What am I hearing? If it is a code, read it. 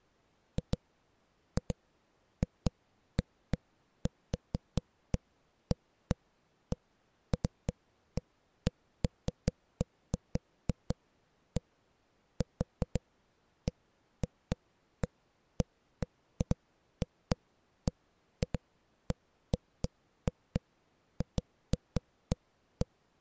Irregular knocks on a wall. There is no code.